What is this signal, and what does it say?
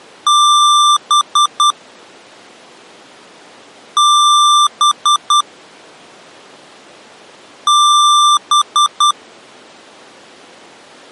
Beep code, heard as beeps from a small speaker, played three times, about 1180 Hz. 1 long, 3 short. In Award and IBM BIOS tables: video adapter failure; in AMI BIOS tables: memory failure.